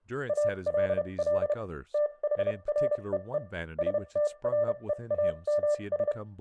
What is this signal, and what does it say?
Morse code, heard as a keyed tone, machine-sent, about 31 wpm, spaced as for 26 wpm, 590 Hz, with room echo and speech in English. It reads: ALL THREE STREAMS